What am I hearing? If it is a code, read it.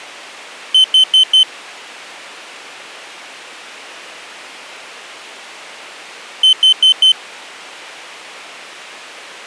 Alarm pattern, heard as an alarm's beeps, played twice, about 3050 Hz. Temporal four. Carbon monoxide.